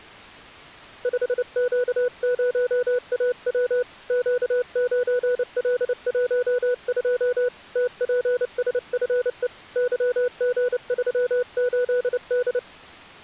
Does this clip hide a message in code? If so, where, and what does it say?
Yes: Morse code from 1.0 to 12.7 s, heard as a keyed tone, hand-sent with a paddle, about 29 wpm, 490 Hz. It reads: 5Q0AW Q9L12 TPSFE YG38D